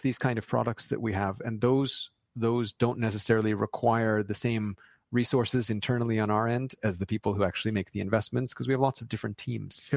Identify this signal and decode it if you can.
Speech in English. There is no code.